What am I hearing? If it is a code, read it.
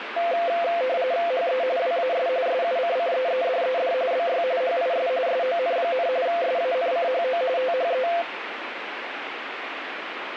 RTTY (45.45 baud, 170 Hz shift), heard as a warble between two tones, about 600 Hz centre, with radio static. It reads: HE WAS SUCCEEDED BY HIS SON, SANCHO THE